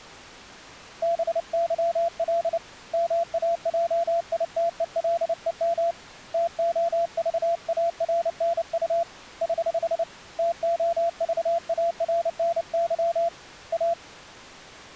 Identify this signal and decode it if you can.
Morse code, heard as a keyed tone, hand-sent with a paddle, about 29 wpm, 680 Hz. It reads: BYL MAJITELEM TOVARNU <HH> TOVARNY A